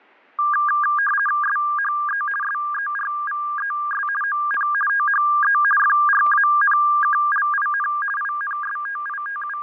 RTTY (50 baud, 450 Hz shift), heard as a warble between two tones, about 1400 Hz centre, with fading and static crashes. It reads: SHE SERVES ON THE FRANKLIN …